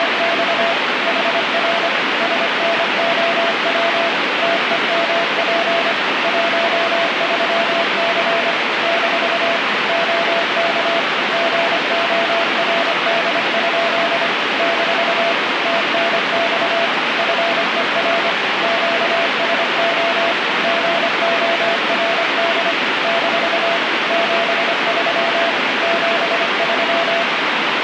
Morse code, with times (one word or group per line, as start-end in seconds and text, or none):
0.0-0.7 …
1.1-1.9 HR
2.2-4.1 SNOW
4.4-5.9 TEMP
6.2-8.5 13C
8.8-9.6 -
9.9-11.0 OK
11.3-14.3 GORD?
14.6-15.3 -
15.7-16.9 TNX
17.2-18.3 FER
18.6-20.3 QSO
20.6-22.7 GORD
23.0-23.8 -
24.1-25.5 73
25.8-27.2 73